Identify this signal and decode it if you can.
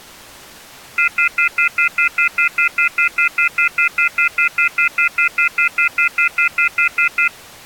Telephone call progress tone (North American plan), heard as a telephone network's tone, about 1400, 2050, 2450, 2600 Hz, 0.1 s on and 0.1 s off. Off-hook warning tone.